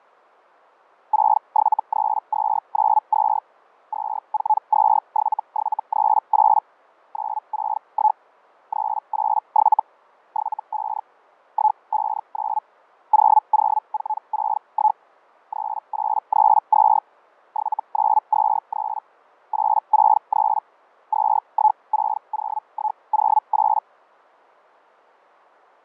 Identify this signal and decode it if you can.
Hellschreiber (Feld-Hell, 122.5 baud), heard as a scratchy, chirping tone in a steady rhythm, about 860 Hz, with fading. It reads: 673292 2427738 961 387 75 159 00461 3832 7923 863 2160108